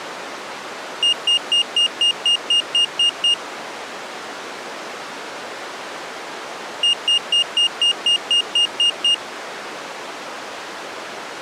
Beep code, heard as a piezo beeper, played twice, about 2850 Hz. 10 short. In AMI BIOS tables: CMOS shutdown register error.